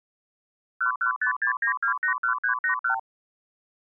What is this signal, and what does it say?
Multi-frequency trunk signalling (R2, with the far end's replies), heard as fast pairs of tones, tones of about 100 ms. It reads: 11569281381